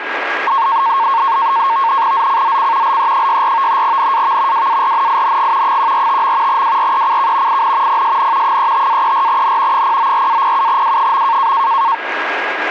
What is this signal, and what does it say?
NAVTEX (SITOR-B), 100 baud, 170 Hz shift, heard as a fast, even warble, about 1000 Hz centre, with radio static and a steady whistle near 1630 Hz. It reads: ZCZC LE64 NAV WARNING 145. WRECK IN PSN 35-34N 094-07W.